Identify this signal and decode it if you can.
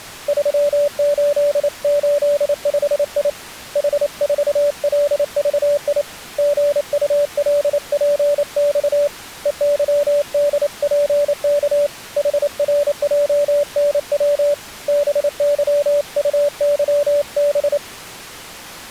Morse code, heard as a keyed tone, hand-sent with a paddle, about 28 wpm, 580 Hz. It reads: 3885I H4LVI GULPX EYDPK HRJNW BYUYB